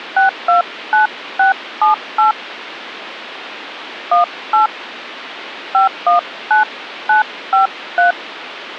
DTMF, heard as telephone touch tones, dialled by hand, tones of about 130 ms, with phone line noise. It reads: 629678 18 519953